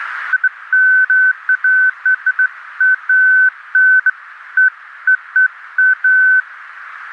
Beeps of irregular length, with radio static. There is no code.